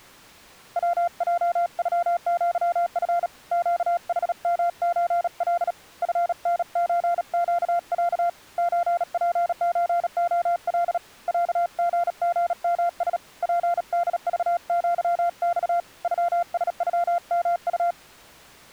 Morse code (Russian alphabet), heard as a keyed tone, hand-sent with a paddle, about 37 wpm, 690 Hz. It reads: ВЙЮЪФ ЩХМЧЛ ФНЧЩЯ ЧПЧОЛ ЯГГМС ПДЖЪЬ ЮСЮМУ